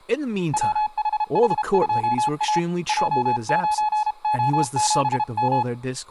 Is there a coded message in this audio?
Yes: Morse code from 0.5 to 5.7 s, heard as a keyed tone, hand-sent with a paddle, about 32 wpm, 850 Hz, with speech in English. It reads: WHH2A J9O7M